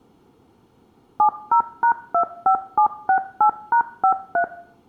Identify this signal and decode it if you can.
DTMF, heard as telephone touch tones, dialled by machine, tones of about 90 ms, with room echo. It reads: 70#25768#53